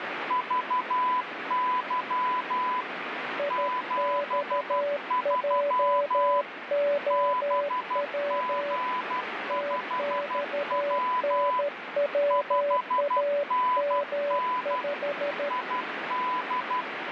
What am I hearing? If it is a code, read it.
Morse code, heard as two keyed tones, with radio static. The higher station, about 12 wpm, 1000 Hz: VY 73 BG5W 5NN ID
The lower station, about 13 wpm, 580 Hz: IXJOW TXNWAM5